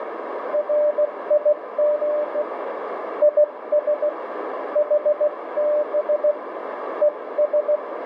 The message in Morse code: RIG IS HB ES

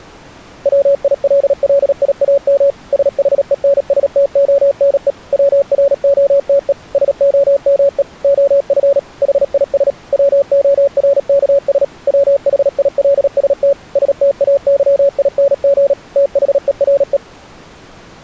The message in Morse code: WILLIAM SHENSTONE WROTE SOME OF HIS WORKS WHILST STAYING THERE

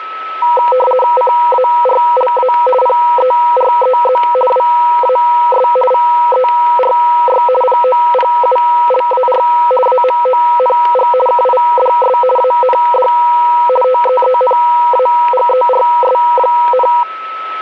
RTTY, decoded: CARLA PEREZ WAS VERY POPULAR AMONG KIDS AND TEENAGERS,

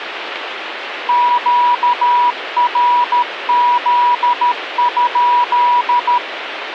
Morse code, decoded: QRZ?

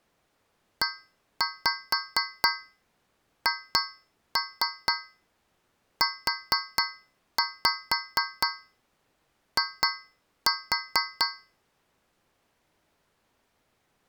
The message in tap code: EHUI

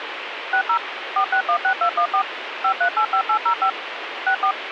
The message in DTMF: 60 4616214 5385805 64

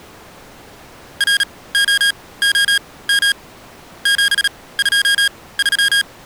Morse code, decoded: ROOM 723

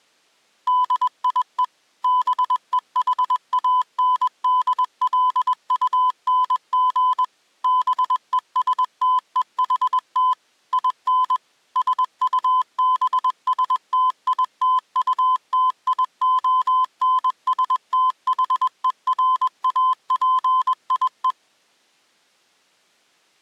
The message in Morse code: DIE BEHANDLUNG BESTEHT IN SUBSTITUTIONSTHERAPIE

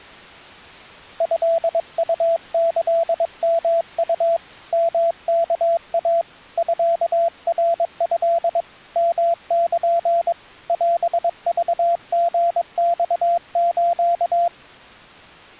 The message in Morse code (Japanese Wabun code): トウキヨウ ヨワイ ミナト ヨル オクリマス

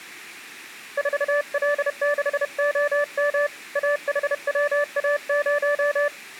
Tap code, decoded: none

